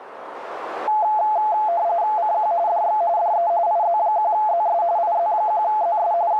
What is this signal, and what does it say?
RTTY (45.45 baud, 170 Hz shift), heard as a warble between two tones, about 770 Hz centre, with radio static and a narrow filter. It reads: CQ DX DE IZ1ZS IZ1ZS …